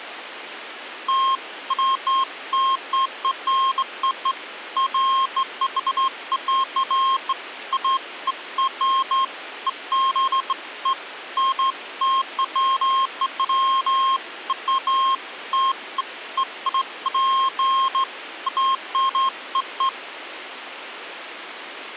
Beeps of irregular length, with phone line noise. There is no code.